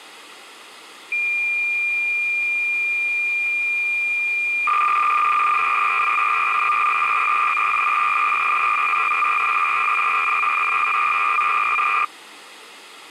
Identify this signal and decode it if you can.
Cassette data (Kansas City type), 300 baud, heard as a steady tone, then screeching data.